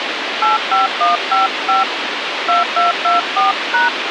DTMF, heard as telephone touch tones, dialled by hand, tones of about 150 ms, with radio hiss. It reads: 85155 2224#